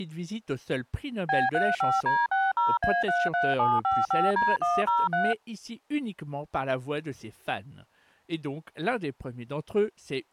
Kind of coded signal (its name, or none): DTMF